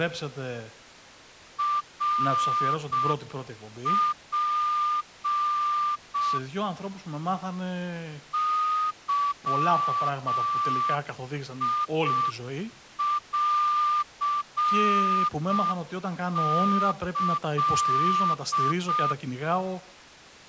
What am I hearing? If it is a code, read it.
Morse code (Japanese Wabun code), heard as a whistle, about 6 wpm, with speech in Greek. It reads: ナツ ゲンキ